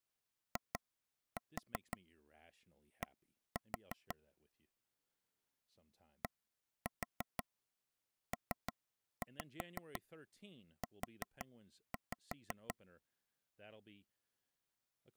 Tap code, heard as taps on a table, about 5 knocks a second, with speech in English. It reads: ID DPU